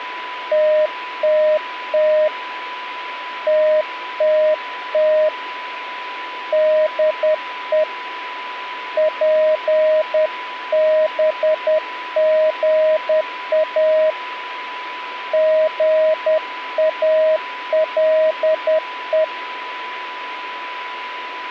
Morse code, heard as a keyed tone, hand-sent with a paddle, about 10 wpm, 620 Hz, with a steady whistle near 990 Hz. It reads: TTT TTT DE PBGA GALE